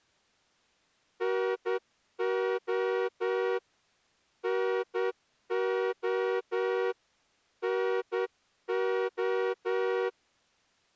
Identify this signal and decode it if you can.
Morse code, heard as a horn, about 10 wpm. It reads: NO NO NO